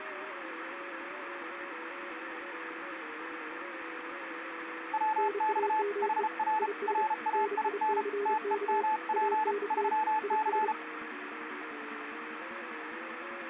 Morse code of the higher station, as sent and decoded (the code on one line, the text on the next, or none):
.-- -..- / .... .-. / .-. .- .. -. / - . -- .--. / ...-- -.-.
WX HR RAIN TEMP 3C